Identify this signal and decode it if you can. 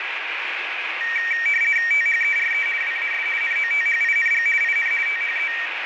RTTY (50 baud, 450 Hz shift), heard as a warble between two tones, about 2100 Hz centre, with radio static. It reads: THERE WAS NOTHING IN THE